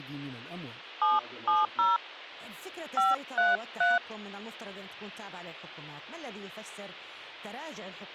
DTMF, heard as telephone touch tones, dialled by hand, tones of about 180 ms, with hum and speech in Arabic. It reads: 770 533